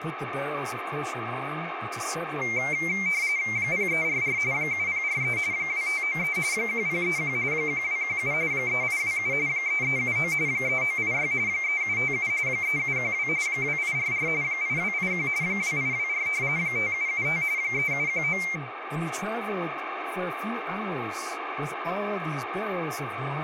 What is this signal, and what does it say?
RTTY (45.45 baud, 170 Hz shift), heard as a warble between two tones, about 2200 Hz centre, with radio static and speech in English. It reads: 0344 7043 2593 1031 1217 3827 3379 3986 3757 3712 2844 8281 2824 5775 3719